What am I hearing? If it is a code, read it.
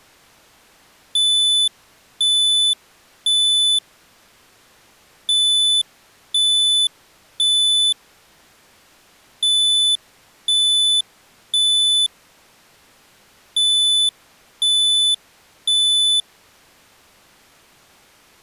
Alarm pattern, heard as an alarm's beeps, played four times, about 3500 Hz. Temporal three. Smoke or fire, evacuate.